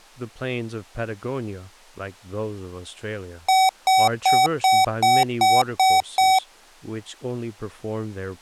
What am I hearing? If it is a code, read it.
Beep code, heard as beeps from a small speaker, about 760 Hz, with speech in English. 8 short. In AMI BIOS tables: display memory failure; in Dell tables: LCD failure.